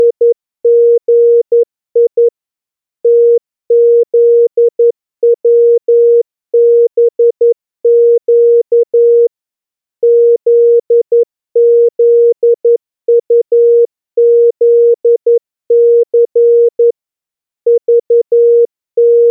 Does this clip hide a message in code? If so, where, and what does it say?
Yes: Morse code (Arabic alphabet) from 0.0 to 19.3 s, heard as a keyed tone, machine-sent, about 11 wpm, 470 Hz. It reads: … تذوبق ذذطذث …